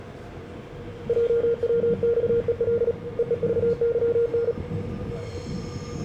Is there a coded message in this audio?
Yes: Morse code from 1.0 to 4.6 s, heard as a keyed tone, hand-sent with a paddle, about 37 wpm, 470 Hz, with the noise inside a subway train. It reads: JWXEL EEVYN